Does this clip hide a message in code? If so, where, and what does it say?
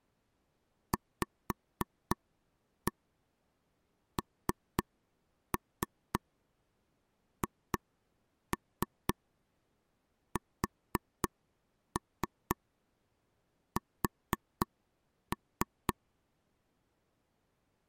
Yes: tap code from 0.9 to 15.9 s, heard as taps on a table, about 3 knocks a second. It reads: VNHSS